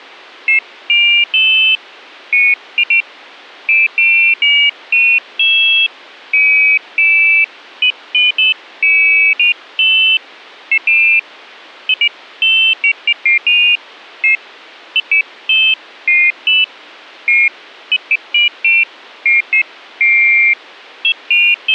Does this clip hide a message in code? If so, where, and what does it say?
No, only pairs of high tones at irregular times.